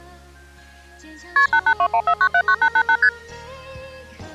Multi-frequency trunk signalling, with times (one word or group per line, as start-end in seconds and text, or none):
1.4-1.5 KP
1.5-3.0 88214979888
3.0-3.1 ST